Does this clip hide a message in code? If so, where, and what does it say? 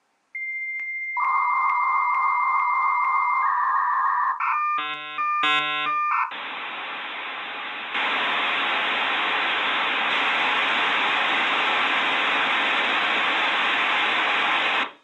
Yes: dial-up modem handshake (V.34 or later) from 0.3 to 14.8 s, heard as a whistle, warbles, then hiss.